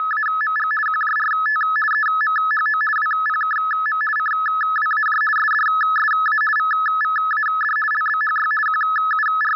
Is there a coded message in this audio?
Yes: RTTY (50 baud, 450 Hz shift) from 0.0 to 9.6 s, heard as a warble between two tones, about 1500 Hz centre. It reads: … QJRT EMHO WPKM CWAJ SDSA VVAD LBHY …